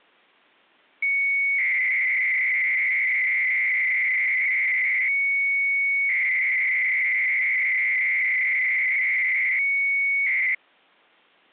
300-baud modem data (Bell 103 tones), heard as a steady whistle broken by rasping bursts, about 300 baud, 200 Hz shift.